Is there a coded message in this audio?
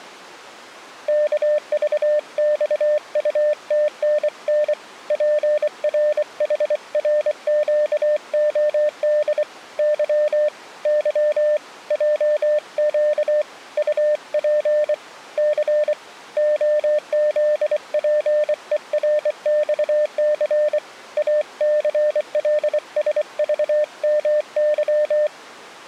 Yes: Morse code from 1.0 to 25.3 s, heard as a keyed tone, hand-sent with a bug key, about 24 wpm, 600 Hz. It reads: KVXUTNN PRHRQOD Y Y JQ UP C OZPERXC ACLSVMY